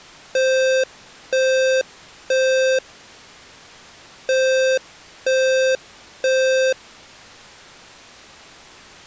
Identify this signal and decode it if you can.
Alarm pattern, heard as an alarm's beeps, played twice, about 520 Hz. Temporal three. Smoke or fire, evacuate.